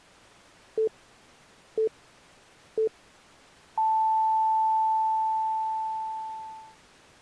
Radio time signal (three low pips and a long one an octave up, as on NHK), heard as pips.